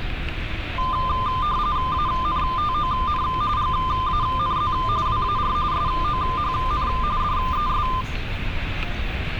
RTTY (45.45 baud, 170 Hz shift), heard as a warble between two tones, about 1120 Hz centre, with radio static and street noise. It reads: ANTON GANZ WAR SOHN DES